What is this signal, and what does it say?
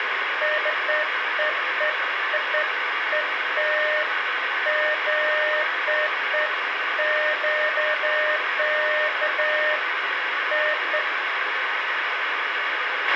Beeps of irregular length, with radio hiss and a squelch burst at the end. There is no code.